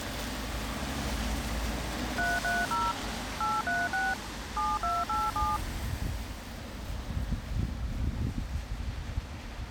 DTMF, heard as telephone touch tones, dialled by machine, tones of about 210 ms, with street noise. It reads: 330 836 7287